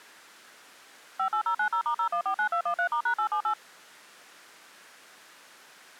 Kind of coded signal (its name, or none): DTMF